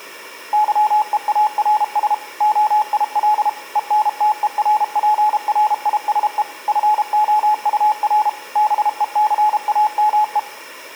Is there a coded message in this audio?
Yes: Morse code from 0.5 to 10.5 s, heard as a keyed tone, machine-sent, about 32 wpm, 850 Hz, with room echo. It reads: YEARS OIL ENTERPRISE FOUR BECAME